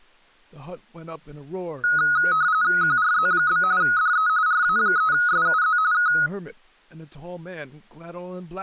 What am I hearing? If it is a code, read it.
RTTY (45.45 baud, 170 Hz shift), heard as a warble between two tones, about 1360 Hz centre, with speech in English. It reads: QRZ? DE RA3SUZ K